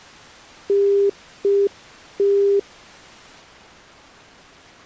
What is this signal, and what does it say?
Telephone call progress tone (UK plan), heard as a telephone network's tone, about 400 Hz. Congestion tone.